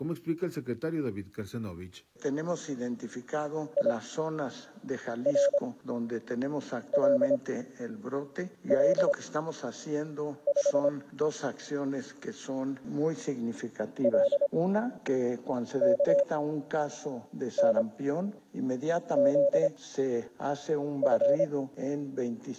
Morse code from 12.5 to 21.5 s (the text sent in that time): LKNZF